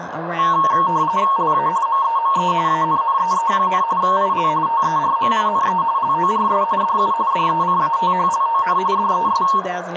RTTY (45.45 baud, 170 Hz shift), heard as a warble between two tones, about 1000 Hz centre, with radio static, a narrow filter, room echo and speech in English. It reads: LA MEME ANNEE, IL TERMINE LORS DU DECATHLON DES